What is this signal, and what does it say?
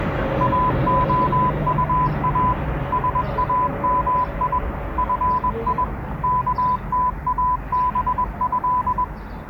Morse code (Arabic alphabet), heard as a keyed tone, machine-sent, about 21 wpm, 1000 Hz, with the noise of a residential street. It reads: اخطا سامي في كتابه